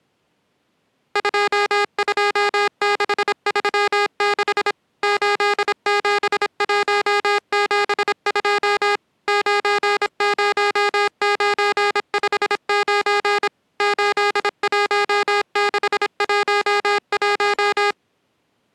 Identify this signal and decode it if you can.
Morse code, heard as electronic beeps, machine-sent, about 26 wpm, 410 Hz. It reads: 22636 87172 90959 81611